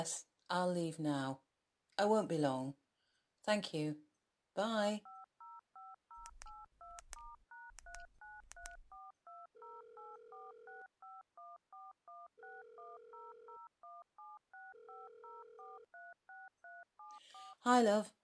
DTMF, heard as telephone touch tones, dialled by machine, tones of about 190 ms, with speech in English. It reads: 2505082*#3934208465141610017650436374